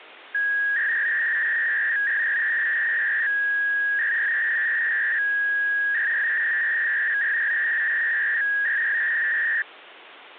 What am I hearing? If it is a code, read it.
300-baud modem data (V.21 tones), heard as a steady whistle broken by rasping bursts, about 300 baud, 200 Hz shift.